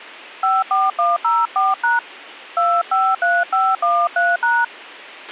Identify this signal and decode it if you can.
DTMF, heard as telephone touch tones, dialled by hand, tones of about 210 ms, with a squelch burst at the end. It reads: 54104# 253513#